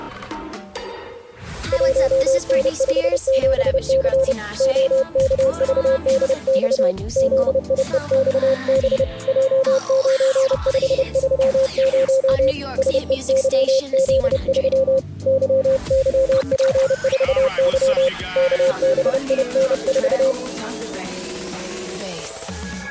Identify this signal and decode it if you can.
Morse code, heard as a keyed tone, hand-sent with a paddle, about 30 wpm, 530 Hz. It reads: 1N57C OKVDX ZIEXB J9530 SEYZ3 YYP4Y KBIN4